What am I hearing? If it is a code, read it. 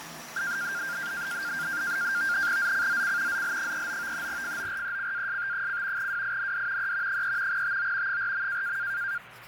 NAVTEX (SITOR-B), 100 baud, 170 Hz shift, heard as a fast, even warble, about 1500 Hz centre, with radio static, fading and the noise of a restroom. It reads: ZCZC ZL39 FORECAST: WIND E 3 TO 4.